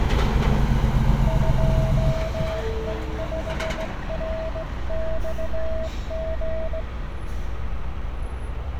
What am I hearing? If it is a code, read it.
Morse code, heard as a keyed tone, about 17 wpm, 640 Hz, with street noise. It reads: 2E5RXG